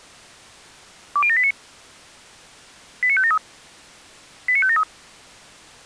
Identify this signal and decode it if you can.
Five-tone selective call (ZVEI), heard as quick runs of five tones, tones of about 70 ms. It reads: 20789 89573 89573